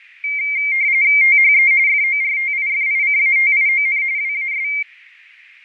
RTTY (45.45 baud, 170 Hz shift), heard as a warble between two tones, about 2200 Hz centre, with fading. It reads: THE FORTIFICATION WAS